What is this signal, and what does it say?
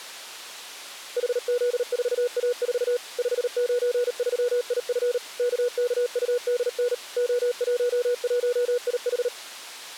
Morse code, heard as a keyed tone, machine-sent, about 38 wpm, 490 Hz. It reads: HZ4A4 593IF KKUDN O11IH